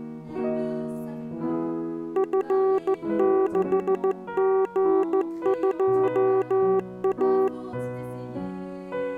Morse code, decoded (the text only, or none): F6G2A